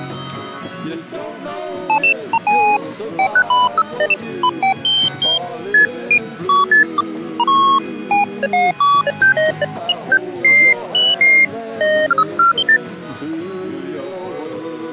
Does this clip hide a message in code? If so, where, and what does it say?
No, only electronic bleeps of random pitch and length.